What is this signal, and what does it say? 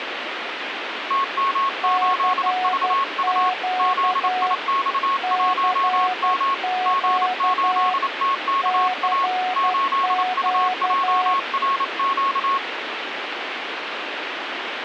Morse code, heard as two keyed tones, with radio static. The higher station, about 28 wpm, 1100 Hz: TM8VU ZIX1M G8TKA 8UJRQ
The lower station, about 12 wpm, 740 Hz: CQ CQ CQ